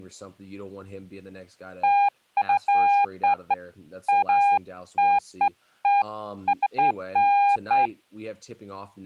Beeps of irregular length, with speech in English. There is no code.